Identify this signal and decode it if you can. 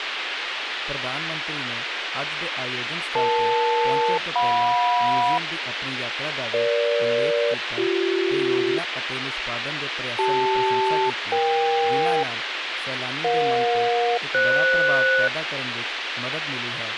Aircraft SELCAL, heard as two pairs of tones, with radio hiss and speech in Punjabi. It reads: EL-JM EG-BC CL-EK EJ-FS